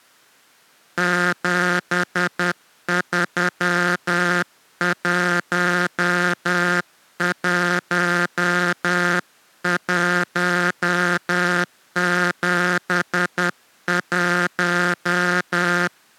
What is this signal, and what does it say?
Morse code, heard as a buzzer, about 10 wpm. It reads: 7311171